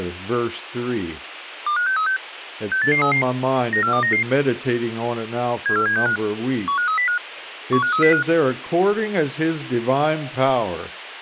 Five-tone selective call (CCIR), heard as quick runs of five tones, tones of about 100 ms, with radio hiss. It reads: 25636 68833 94299 74765 15305 15305